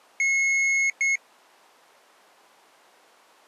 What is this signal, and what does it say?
Beep code, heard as a piezo beeper, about 2150 Hz. 1 long, 1 short. In IBM BIOS tables: system board problem.